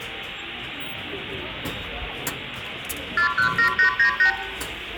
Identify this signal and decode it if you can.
Multi-frequency trunk signalling (R2, with the far end's replies), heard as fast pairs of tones, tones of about 100 ms, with phone line noise, room echo and the noise of a subway station. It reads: 417898